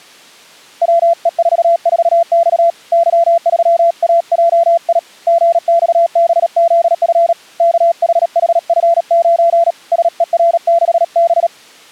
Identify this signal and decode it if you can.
Morse code, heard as a keyed tone, hand-sent with a paddle, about 37 wpm, 680 Hz. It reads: WE44X Y3AJI GXBZF KHHF9 SER6B